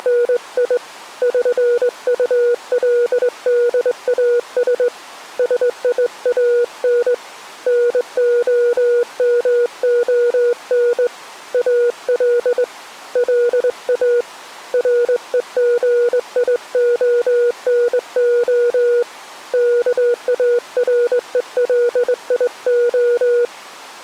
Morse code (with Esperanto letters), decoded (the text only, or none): … ŜULDAS SIAN NOMON AL LA REGIONO KARELIO